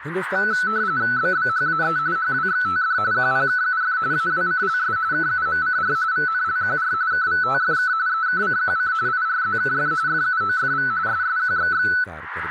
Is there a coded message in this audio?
Yes: RTTY (45.45 baud, 170 Hz shift) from 0.4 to 12.0 s, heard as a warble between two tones, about 1400 Hz centre, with radio static, a narrow filter and speech in Kashmiri. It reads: BBHAE HWXTD QPKUF AWCLS KUMCR VNLQR KVTFK EKCQC IRZKF FUOFV SSQXX